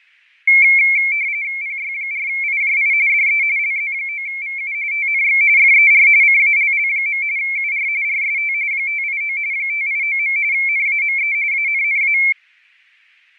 RTTY (45.45 baud, 170 Hz shift), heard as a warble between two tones, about 2250 Hz centre, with fading. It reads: PY4IJI DE LZ9VU TNX FER CALL. UR RST 589 589. NAME ANNA